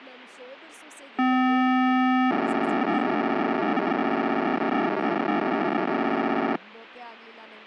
POCSAG pager data (512 baud), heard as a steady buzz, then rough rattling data, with speech in Kannada.